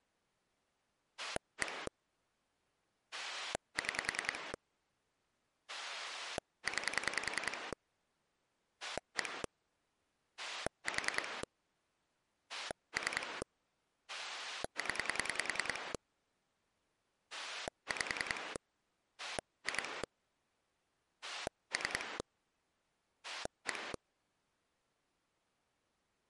Pulse dialling, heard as a rotary dial, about 10 pulses a second. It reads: 1 6 9 1 4 3 0 5 2 3 1